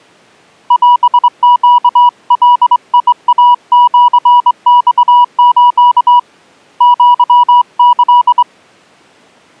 Morse code (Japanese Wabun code), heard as a keyed tone, hand-sent with a straight key, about 23 wpm, 970 Hz. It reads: オネガイシマス アキ